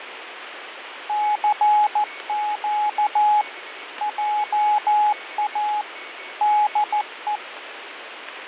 Morse code, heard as a keyed tone, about 14 wpm, 840 Hz, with radio static and a weaker station near 2220 Hz. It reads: CQ JA DE